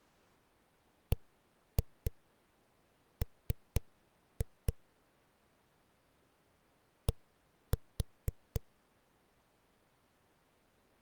Tap code, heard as knocks on a wall, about 4 knocks a second. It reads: BM D